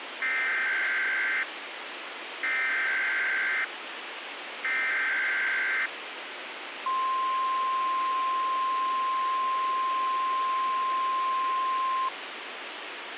Emergency Alert System (SAME) tones (header bursts, then the 1050 Hz attention tone), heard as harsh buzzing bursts, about 520.83 baud, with radio hiss.